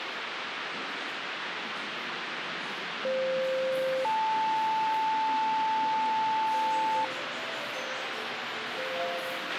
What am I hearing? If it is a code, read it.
Two-tone page, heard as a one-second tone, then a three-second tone, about 520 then 880 Hz, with radio hiss, a squelch burst at the end and the noise of a subway station.